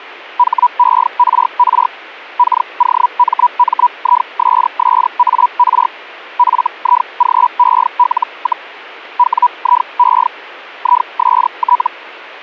Hellschreiber (Feld-Hell, 122.5 baud), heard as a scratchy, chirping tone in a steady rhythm, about 980 Hz. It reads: HERR KOMMISSAR FIGEL, WIE IST